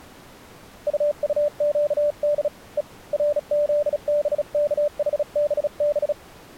Morse code, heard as a keyed tone, hand-sent with a bug key, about 36 wpm, 590 Hz. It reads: UUQD E RZBKHBB